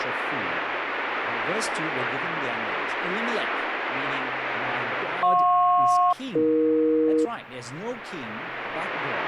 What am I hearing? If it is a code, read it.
Aircraft SELCAL, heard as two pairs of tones, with radio static. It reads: JP-AE